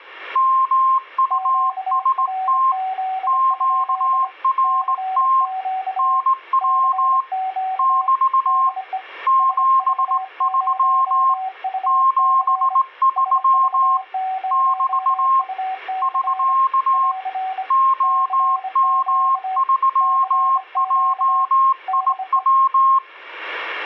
Morse code, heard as two keyed tones. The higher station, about 18 wpm, 1060 Hz: MUST QRT NW <BT> 73 73 <BT> <SK> OM3JIW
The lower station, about 25 wpm, 760 Hz: QRZ? CQ CQ DE SV0UC SV0UC <AR> CQ CQ DE